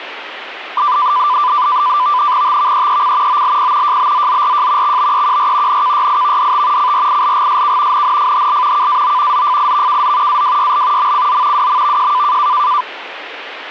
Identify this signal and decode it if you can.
NAVTEX (SITOR-B), 100 baud, 170 Hz shift, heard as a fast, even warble, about 1090 Hz centre, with radio static. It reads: TVEEC OLP JBZZRJ XBEQR NKYIVDT CRILGSK NNFHL KAO ZFIVKZ AWYL MCZ WMVJ